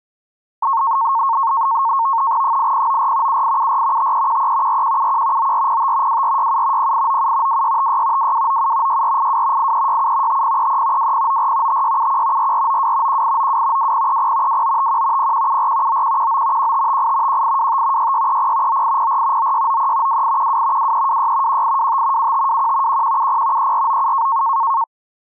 NAVTEX (SITOR-B), 100 baud, 170 Hz shift, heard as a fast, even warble, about 1000 Hz centre. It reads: 8094 7874 5313 4171 9405 2467 0897 2656 2297 6482 8367 5033 2094 5671 4492 1892 2030 2951 0174 9119 1558 1825 6630 9804 9693 2812 2326 1825 7521 1170 3497